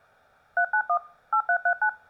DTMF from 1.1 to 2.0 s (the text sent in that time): 8339